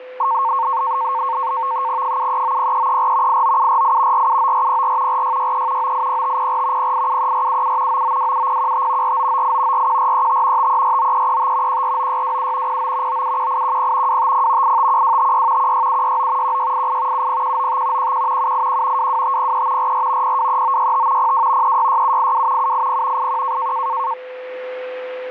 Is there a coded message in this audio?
Yes: NAVTEX (SITOR-B), 100 baud, 170 Hz shift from 0.2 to 24.1 s, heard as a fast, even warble, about 1000 Hz centre, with a steady whistle near 510 Hz. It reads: 7390334 89748 479404 4663 980504 0873477 9927015 4998 41435 5349335 149627 09 971810 250 851256 16769 1688 70195 11 781 22503 44 023965 02 366782 780 81